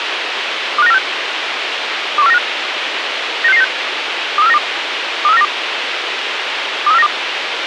Five-tone selective call (EEA), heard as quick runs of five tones, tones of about 40 ms, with radio hiss. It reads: 25946 21495 96696 23492 23492 23492